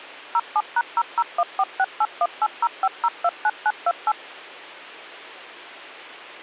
DTMF, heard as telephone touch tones, dialled by machine, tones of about 50 ms, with hum. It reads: 07#0014681805029928